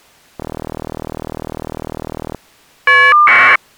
Caller ID data burst, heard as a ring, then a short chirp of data, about 1200 baud.